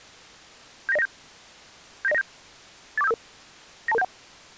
Five-tone selective call (EIA), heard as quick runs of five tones, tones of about 30 ms. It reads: 79097 79097 84755 92271